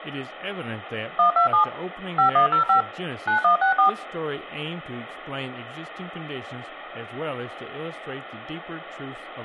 DTMF, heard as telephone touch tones, dialled by machine, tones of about 110 ms, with phone line noise, room echo and speech in English. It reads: 127 5105 9164